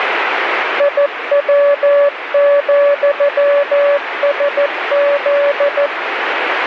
Morse code, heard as a keyed tone, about 14 wpm, 570 Hz, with radio static. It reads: IW,SZ